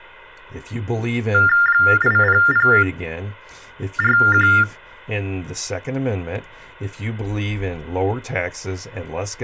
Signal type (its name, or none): TTY/TDD text telephone tones